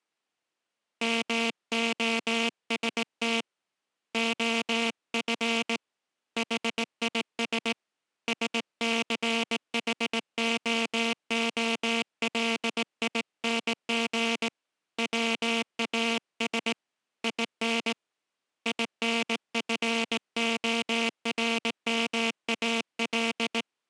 Morse code, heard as a buzzer, hand-sent with a straight key, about 18 wpm. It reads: MOST OF HIS SCHOOLING WAS IN INFORMAL